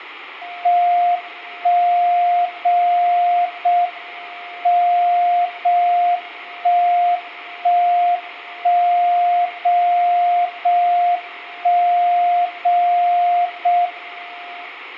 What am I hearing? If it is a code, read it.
Radio time signal (JJY), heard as a tone whose level steps once a second, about 700 Hz, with room echo. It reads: 1 0 0 M 0 1 1 1 0 0 1 0 0 M